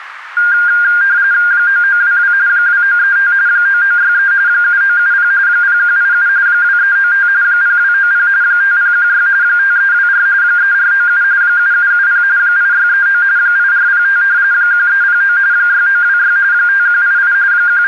RTTY (45.45 baud, 170 Hz shift), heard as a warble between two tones, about 1500 Hz centre, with radio static. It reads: 9922 2935 9963 7970 0187 2395 0290 5016 5324 3497 7770 8639 8405 1309 6926 5188 …